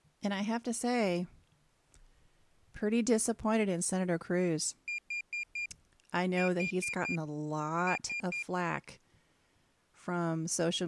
Beep code, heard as a piezo beeper, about 2400 Hz, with speech in English. 4-4-3. In Phoenix BIOS tables: maths coprocessor failure.